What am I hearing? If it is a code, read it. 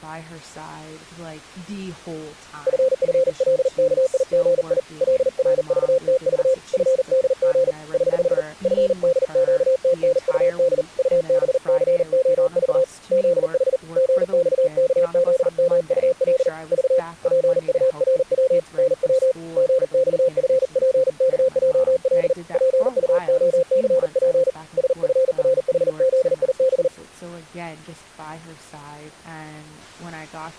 Morse code, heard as a keyed tone, hand-sent with a paddle, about 39 wpm, 520 Hz, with speech in English. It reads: FFLKIGI LRVTV FDG <HH> FDQTNUD UBCOV ZH GXKZMUL V PURW NW GXFPKJL PUOCP SFRHZIB